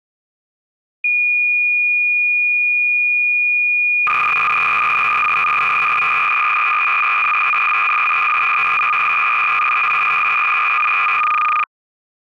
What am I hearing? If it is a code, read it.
Cassette data (Kansas City type), 300 baud, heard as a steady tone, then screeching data.